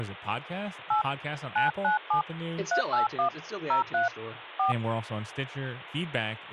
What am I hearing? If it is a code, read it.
DTMF, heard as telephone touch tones, dialled by hand, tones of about 130 ms, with phone line noise and speech in English. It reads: 8 997 381 03 4